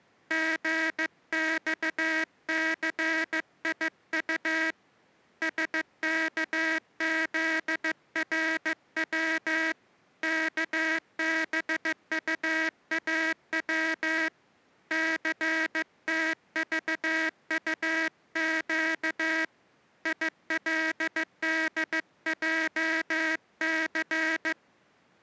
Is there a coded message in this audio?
Yes: Morse code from 0.2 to 24.6 s, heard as a buzzer, hand-sent with a paddle, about 15 wpm. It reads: GXCIU SKZRW KBUAW CTVUQ ILDJC